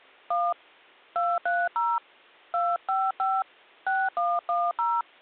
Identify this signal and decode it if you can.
DTMF, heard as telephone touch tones, dialled by hand, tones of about 220 ms. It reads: 1 230 255 6110